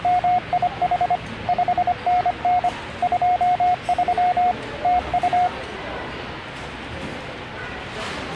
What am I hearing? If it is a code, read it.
Morse code, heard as a keyed tone, machine-sent, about 25 wpm, 720 Hz, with the noise of a restaurant. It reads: … 5NN 23 TU